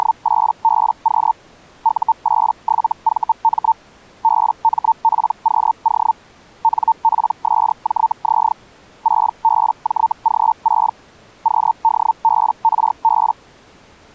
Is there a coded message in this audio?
Yes: Hellschreiber (Feld-Hell, 122.5 baud) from 0.0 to 13.3 s, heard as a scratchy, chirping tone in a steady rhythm, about 900 Hz. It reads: … U87VM BMPQO NPSJZ 6BJG6 QDBRB